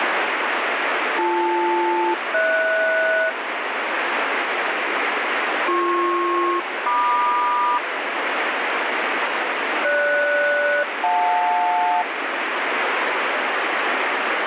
Aircraft SELCAL, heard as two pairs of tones, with radio static. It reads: BL-HS BP-MQ GS-JL